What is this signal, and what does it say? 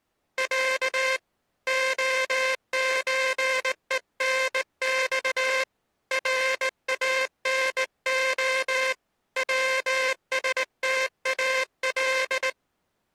Morse code (Russian alphabet), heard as a buzzer, hand-sent with a straight key, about 19 wpm. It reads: Я ОЧЕНЬ РАНО ВСТАЛ